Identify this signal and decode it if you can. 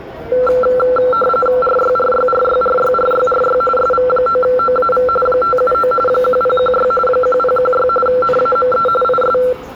RTTY (45.45 baud, 850 Hz shift), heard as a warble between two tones, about 930 Hz centre, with the noise of a subway station. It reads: RYRYRYRYRYRY SV9OAV 579 1016 1016 NAME IS